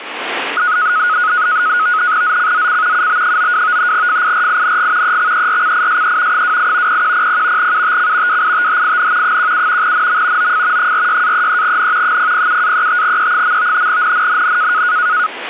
NAVTEX (SITOR-B), 100 baud, 170 Hz shift, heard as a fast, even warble, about 1360 Hz centre, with radio static. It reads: ZCZC UB92 FIRING EXERCISE 28 0100 UTC WITHIN 17 NM OF 46-33N 007-35E. NNNN